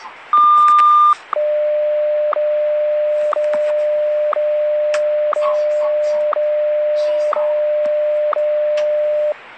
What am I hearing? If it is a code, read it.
Radio time signal (WWVH, Hawaii), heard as ticks, one a second, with the noise inside a lift.